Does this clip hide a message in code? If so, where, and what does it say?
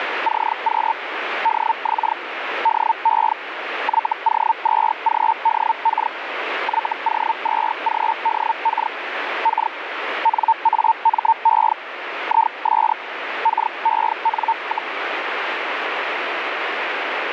Yes: Hellschreiber (Feld-Hell, 122.5 baud) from 0.2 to 14.9 s, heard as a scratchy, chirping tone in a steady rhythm, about 900 Hz, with radio static. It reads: CQ DX DE YO2GDK YO2GDK K NAME IS KEN,